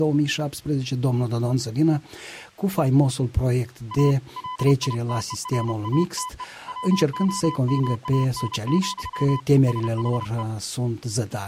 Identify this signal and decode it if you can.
Morse code, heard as a keyed tone, hand-sent with a paddle, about 31 wpm, 1010 Hz. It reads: A LITERATE WOMAN, SHE